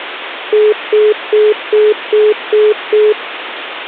Telephone call progress tone (single-tone plan, as in most of Europe), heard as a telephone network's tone, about 420 Hz, 0.2 s on and 0.2 s off, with phone line noise. Congestion tone.